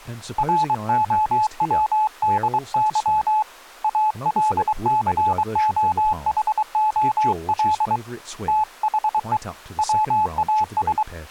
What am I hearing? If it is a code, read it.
Morse code, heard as a keyed tone, hand-sent with a paddle, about 23 wpm, 860 Hz, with speech in English. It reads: ROWDY ALCOHOL THE WAS